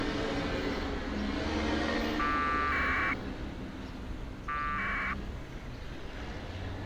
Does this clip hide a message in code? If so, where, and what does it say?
Yes: packet radio (AX.25, as in APRS), 1200 baud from 2.2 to 5.1 s, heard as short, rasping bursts, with street noise.